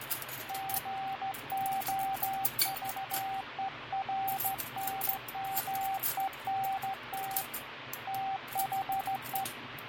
Morse code, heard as a keyed tone, hand-sent with a straight key, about 15 wpm, 780 Hz, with radio static, fading and kitchen noise. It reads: GOVERNMENT THE